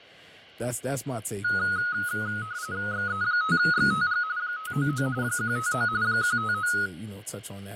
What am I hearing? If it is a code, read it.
RTTY (45.45 baud, 170 Hz shift), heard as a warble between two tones, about 1360 Hz centre, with fading and speech in English. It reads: XE5XTG 599 159 159